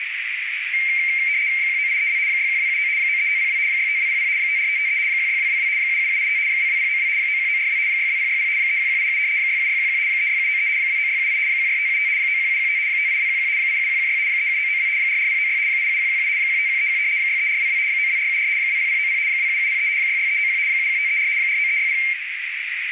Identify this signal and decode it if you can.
RTTY (75 baud, 170 Hz shift), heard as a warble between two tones, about 2200 Hz centre, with radio static and a narrow filter. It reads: 19832 61279 93502 65200 54553 16222 77785 22092 91942 62060 31187 67611 36793 29678 16575 91715 58211 87116 37992 44096 87117 15131 63422 92474 20090 27703 66391 71534 49360